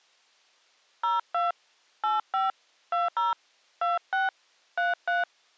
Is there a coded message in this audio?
Yes: DTMF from 1.0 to 5.2 s, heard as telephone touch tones, dialled by hand, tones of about 160 ms. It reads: 02 85 20 26 33